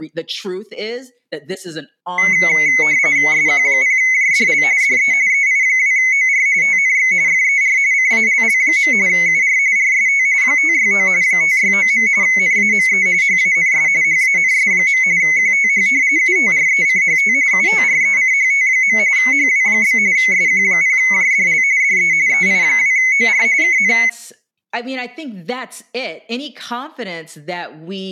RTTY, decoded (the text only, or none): SQ0JDL DE EI2OR TNX FER CALL. UR RST 569 569. NAME HANS HANS. QTH UTRECHT UTRECHT. HW? SQ0JDL DE EI2OR KN